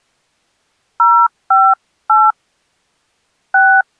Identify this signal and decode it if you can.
DTMF, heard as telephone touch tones, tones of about 210 ms. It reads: 058 6